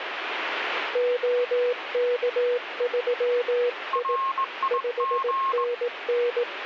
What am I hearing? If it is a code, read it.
Morse code, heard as two keyed tones, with radio static. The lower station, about 18 wpm, 490 Hz: OK3I 5NN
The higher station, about 20 wpm, 1080 Hz: RIG